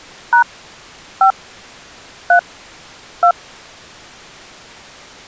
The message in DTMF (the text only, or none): # 5 3 2